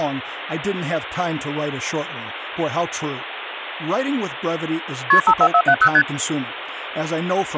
Multi-frequency trunk signalling (R1, as on North American trunks), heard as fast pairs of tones, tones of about 70 ms, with phone line noise and speech in English. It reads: KP 54470 ST